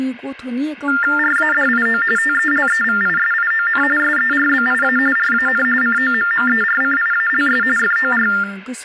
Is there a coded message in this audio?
Yes: TTY/TDD text telephone tones (45.45 baud Baudot) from 0.9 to 8.4 s, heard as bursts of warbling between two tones, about 400 Hz shift, 1600 Hz centre, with speech in Bodo. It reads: RADIO TELEVISION SERBIA RAN COMMERCIALS FOR